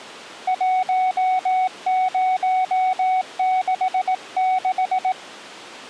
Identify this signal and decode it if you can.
Morse code, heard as a keyed tone, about 18 wpm, 750 Hz. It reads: 1066